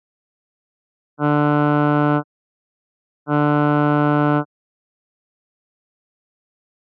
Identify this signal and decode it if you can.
Ship horn signal, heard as a ship's horn, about 150 Hz. 2 short. At sea: I am altering course to port.